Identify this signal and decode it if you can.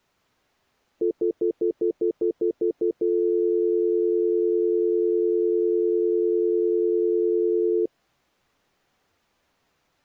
Telephone call progress tone (North American plan), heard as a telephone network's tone, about 350, 440 Hz, 0.1 s on and 0.1 s off. Stutter dial tone.